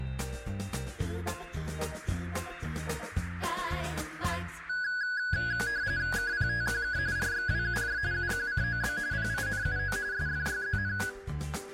RTTY (45.45 baud, 170 Hz shift), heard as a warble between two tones, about 1550 Hz centre. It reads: KPTQK RXWUJ UQCOB PINUO SFYZN